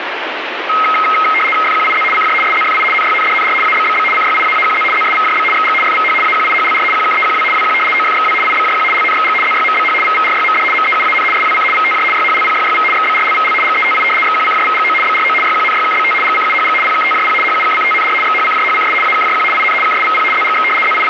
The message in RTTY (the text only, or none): FQIZ CJ SZFI NYNDNR ABBB CYIAAQZ ZSVJB XG FVH AQIHLR QKEQW WQ OFXW IBJQ LNXG ZYMBH VVRYMD MEUAN SWC VTJ YHLPYYV XBRLVL GETI XQCJVGO BRO YQNYKBT GCUHG PKTJP HUKCTNR XHCJHCS AKJQ IN KSVP ZGX …